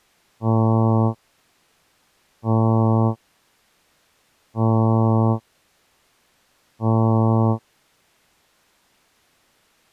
Ship horn signal, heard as a ship's horn, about 110 Hz. 4 short. At sea: a pilot vessel's identity signal in fog.